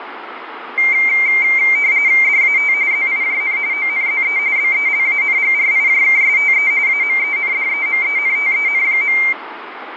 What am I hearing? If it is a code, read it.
RTTY (45.45 baud, 170 Hz shift), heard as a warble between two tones, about 2200 Hz centre, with radio static. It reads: DAT ZIJN ONZE BELANGRIJKSTE AMENDEMENTEN.